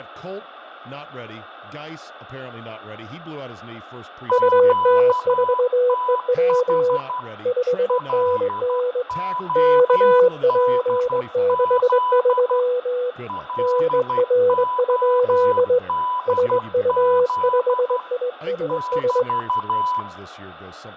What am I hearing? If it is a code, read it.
Morse code, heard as two keyed tones, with fading, room echo and speech in English. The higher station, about 12 wpm, 1000 Hz: QTH LODZ LODZ <BT>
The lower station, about 21 wpm, 500 Hz: UT4EW 5NN KP63 NR? SU5ISS